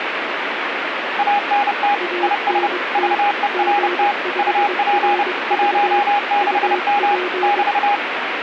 Morse code, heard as two keyed tones, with radio static. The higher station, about 30 wpm, 820 Hz: ANT IS VERT UP 16M <BT>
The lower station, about 22 wpm, 360 Hz: ANT G5RV UP